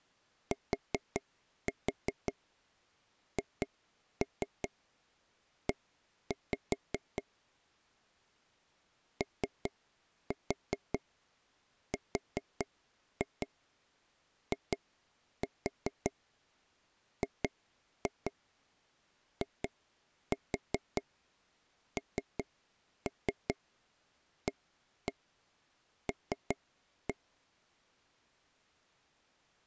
Tap code, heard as taps on a table, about 5 knocks a second. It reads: THE ORIGINAL